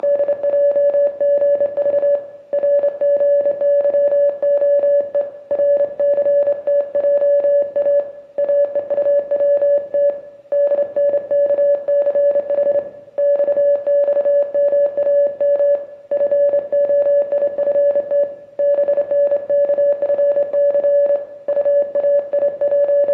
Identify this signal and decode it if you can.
Morse code, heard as a keyed tone, hand-sent with a straight key, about 27 wpm, 570 Hz, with room echo. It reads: … RGYOE RCTJA AEUWT DNKCH XXMAM FOIFT BNKFC …